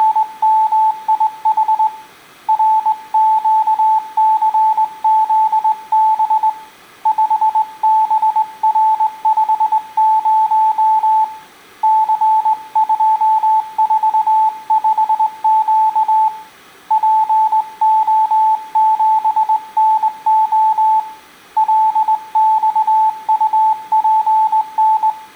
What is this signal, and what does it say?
Morse code, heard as a keyed tone, hand-sent with a straight key, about 20 wpm, 870 Hz, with room echo. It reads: … RQCZB 5BR50 C245Q PO7NO LXUPN